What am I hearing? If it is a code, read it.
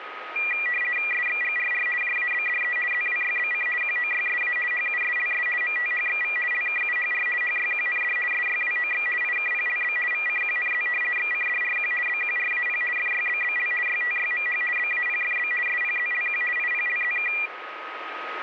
RTTY (50 baud, 450 Hz shift), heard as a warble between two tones, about 2150 Hz centre, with radio static and a steady whistle near 1260 Hz. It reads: SXGRR JABDE ZWYBC QOYSA HUSLS MTHXV LKUHR HYQND SYWOX IKPLB VCQNZ XCDRQ BQRAP FYBBL YTYMH BAPFB SPZLQ IPLZK